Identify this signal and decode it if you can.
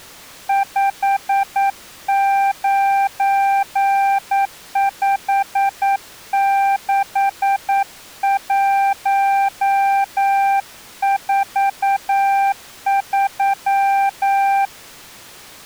Morse code, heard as a keyed tone, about 9 wpm, 790 Hz. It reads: 5956143